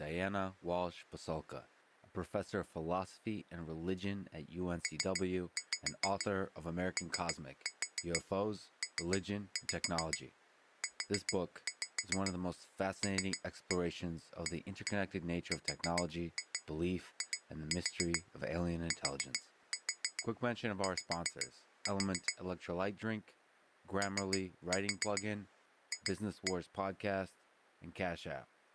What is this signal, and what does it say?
Tap code, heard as taps on glass, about 7 knocks a second, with speech in English. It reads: POPULARITY OF